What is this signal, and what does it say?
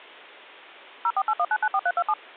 DTMF, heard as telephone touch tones, dialled by machine, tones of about 60 ms. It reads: 0481994327